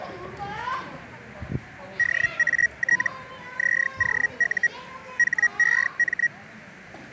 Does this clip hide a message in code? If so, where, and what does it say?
Yes: Hellschreiber (Feld-Hell, 122.5 baud) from 2.0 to 6.3 s, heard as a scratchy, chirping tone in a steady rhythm, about 1900 Hz, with the noise of a park. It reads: DAT ZOU HEM